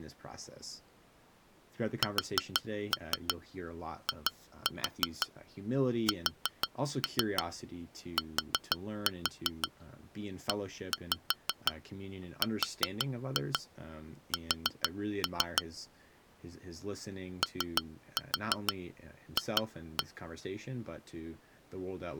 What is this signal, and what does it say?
Tap code, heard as taps on glass, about 6 knocks a second, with speech in English. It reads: SISTERS OF